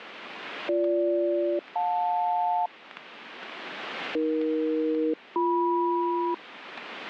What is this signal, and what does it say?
Aircraft SELCAL, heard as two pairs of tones, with radio static. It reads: BG-JL AE-BM